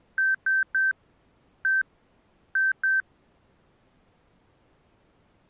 Beep code, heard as beeps from a small speaker, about 1550 Hz. 3-1-2. In Phoenix BIOS tables: DMA register failure.